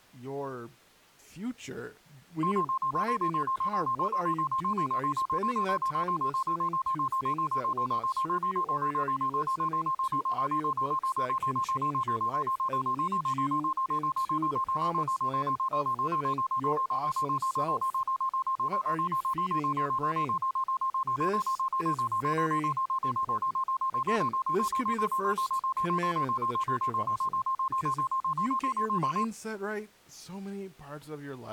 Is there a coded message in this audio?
No, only evenly repeated beeps, with speech in English.